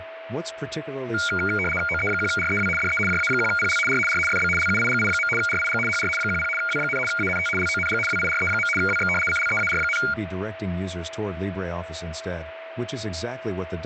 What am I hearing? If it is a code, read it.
RTTY (75 baud, 850 Hz shift), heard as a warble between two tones, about 1850 Hz centre, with radio static, a steady whistle near 650 Hz and speech in English. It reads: OE1REW DE JA1PL R R FB LUIGI. RIG HR 10 W, ANT LONG WIRE. WX CLEAR,